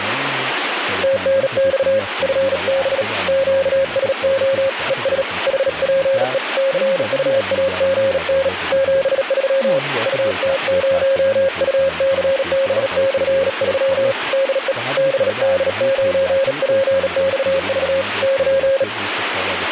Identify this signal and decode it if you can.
Morse code, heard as a keyed tone, hand-sent with a bug key, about 37 wpm, 540 Hz, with radio static and speech in Persian. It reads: TNX FB QSO ES HPE CUAGN 73 UT0UCB/3 DE BD9PXV <KN>